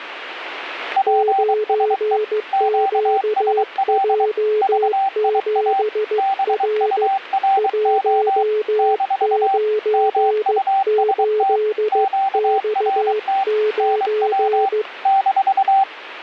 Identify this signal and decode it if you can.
Morse code, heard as two keyed tones, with radio static. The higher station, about 23 wpm, 780 Hz: PSE QSL VIA BURO - MUST QRT NW -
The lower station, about 15 wpm, 430 Hz: 9QJ7R 198X9